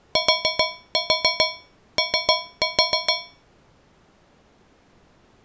Tap code, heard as taps on a metal pipe, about 7 knocks a second. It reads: TO